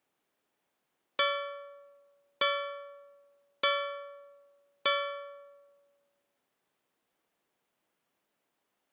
Clock strike, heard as a bell. 4. Four o'clock.